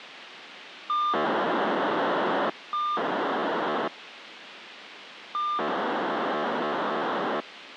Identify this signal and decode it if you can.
POCSAG pager data (2400 baud), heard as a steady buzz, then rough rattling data, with radio hiss.